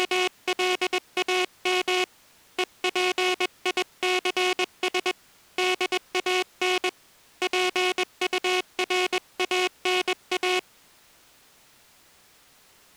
Morse code, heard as a buzzer, hand-sent with a paddle, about 21 wpm. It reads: … EPICS DAN PURANA